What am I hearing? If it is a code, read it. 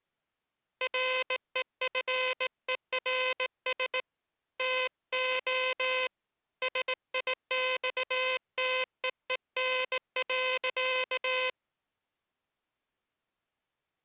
Morse code, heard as a buzzer, hand-sent with a straight key, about 18 wpm. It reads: REFERS TO SIXTEEN.